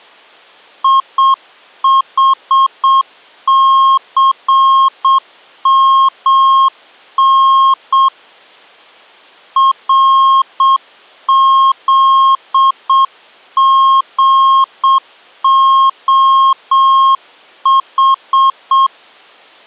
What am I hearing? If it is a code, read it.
Morse code, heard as a keyed tone, hand-sent with a straight key, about 7 wpm, 1070 Hz. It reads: IHCMN RZGOH